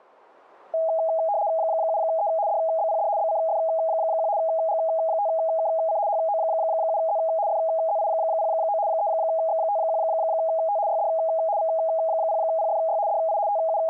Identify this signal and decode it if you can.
RTTY (75 baud, 170 Hz shift), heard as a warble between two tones, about 730 Hz centre. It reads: 7E DBPD BCF1 G5KC HO7Z FZI09 3X51T YD V0PFY DI …